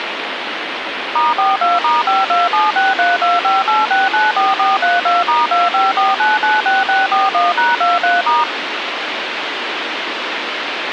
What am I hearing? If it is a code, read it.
DTMF, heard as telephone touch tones, dialled by machine, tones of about 180 ms, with phone line noise. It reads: *42*52763258694432*254996641#23*